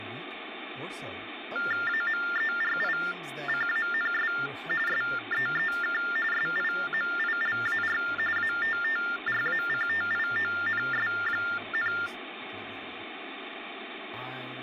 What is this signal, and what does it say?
TTY/TDD text telephone tones (45.45 baud Baudot), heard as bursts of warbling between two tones, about 400 Hz shift, 1600 Hz centre, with phone line noise and speech in English. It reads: AMERICANS SEEK SIMILAR ATTRACTIONS,